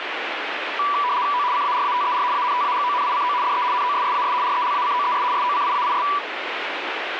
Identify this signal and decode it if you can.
RTTY (75 baud, 170 Hz shift), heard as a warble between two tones, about 1070 Hz centre, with radio static. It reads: O CARATER ANTAGONICO DE NOSSAS RELACOES SOCIAIS